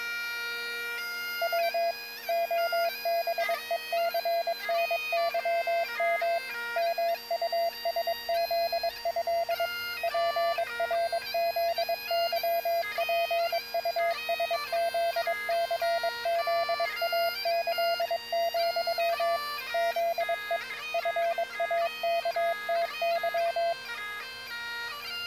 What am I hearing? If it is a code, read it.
Morse code (with Polish letters), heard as a keyed tone, machine-sent, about 22 wpm, 680 Hz. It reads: W OBECNYM MUSZĘ PRZYPUSZCZAĆ, ZE FAKTY